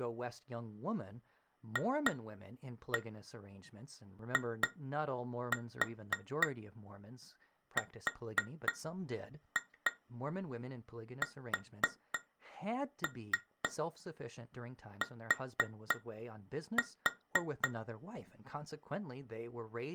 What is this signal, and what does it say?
Tap code, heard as taps on glass, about 3 knocks a second, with speech in English. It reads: FIRST